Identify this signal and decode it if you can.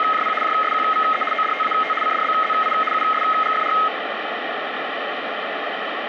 RTTY (75 baud, 850 Hz shift), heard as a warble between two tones, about 1700 Hz centre, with radio static. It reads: … JSQVE ODTAT CDBZI USGFR